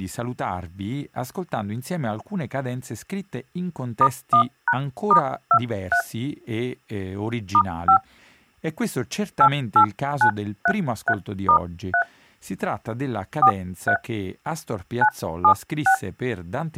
DTMF, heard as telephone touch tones, dialled by hand, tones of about 80 ms. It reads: *1#*23 *5 88933*3 43 976